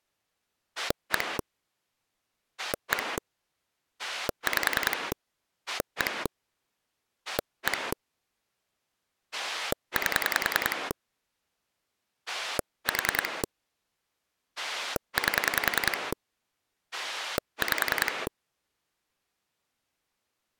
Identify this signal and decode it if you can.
Pulse dialling, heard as a rotary dial, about 10 pulses a second. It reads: 1 1 5 1 1 8 4 8 5